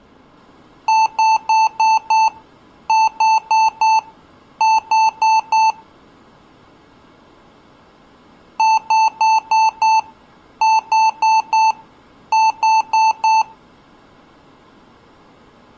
Beep code, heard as beeps from a small speaker, played twice, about 880 Hz. 5-4-4.